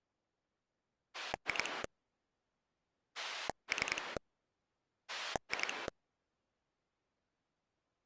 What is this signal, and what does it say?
Pulse dialling, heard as a rotary dial, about 10 pulses a second. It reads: 2 3 2